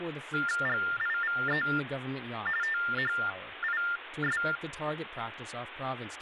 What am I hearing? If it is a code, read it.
TTY/TDD text telephone tones (45.45 baud Baudot), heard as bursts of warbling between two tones, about 400 Hz shift, 1600 Hz centre, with phone line noise and speech in English. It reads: GIVE THIS